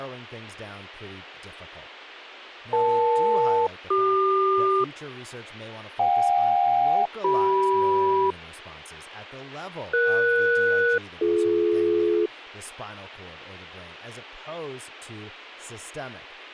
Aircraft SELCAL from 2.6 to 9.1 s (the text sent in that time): EL-CQ JK-CM